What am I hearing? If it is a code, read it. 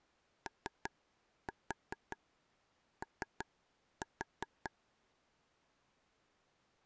Tap code, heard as taps on a table, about 5 knocks a second. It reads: OO